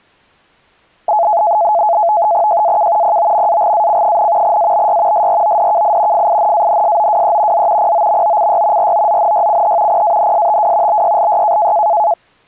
NAVTEX (SITOR-B), 100 baud, 170 Hz shift, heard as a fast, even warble, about 760 Hz centre. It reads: JAK POMAGAC, ABY SRODKI FINANSOWE Z POMOCY ROZNYCH PANSTW BYLY